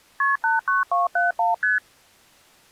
Multi-frequency trunk signalling (R1, as on North American trunks), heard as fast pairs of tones, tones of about 160 ms. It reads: KP 89271 ST